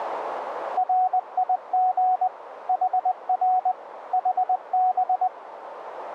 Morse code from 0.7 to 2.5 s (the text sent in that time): RIG